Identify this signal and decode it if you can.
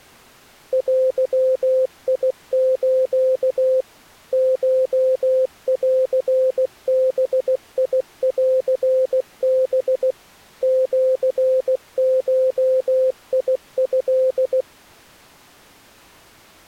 Morse code (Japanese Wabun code), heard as a keyed tone, machine-sent, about 16 wpm, 520 Hz. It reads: デス コンバンハ シゴト